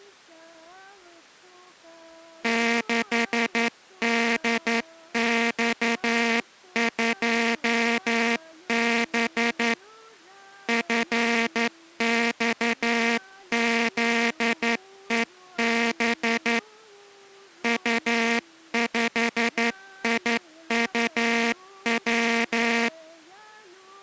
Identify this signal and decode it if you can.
Morse code, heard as a buzzer, hand-sent with a straight key, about 11 wpm. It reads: 6DX2B FXZEB U5IUW